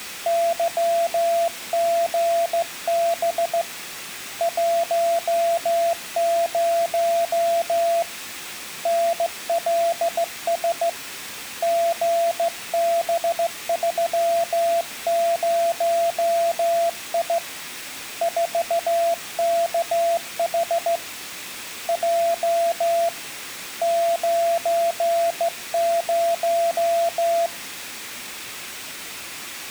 Morse code, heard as a keyed tone, hand-sent with a straight key, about 15 wpm, 680 Hz, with room echo. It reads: YGB 10 NLS GB30I 4KH J 90